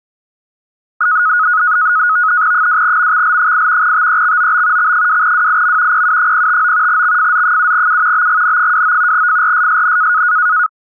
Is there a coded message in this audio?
Yes: NAVTEX (SITOR-B), 100 baud, 170 Hz shift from 1.0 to 10.7 s, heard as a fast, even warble, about 1360 Hz centre. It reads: 2MXL8 TEXOB X2WIM PU059 XFZ7U BGN29 FRSSN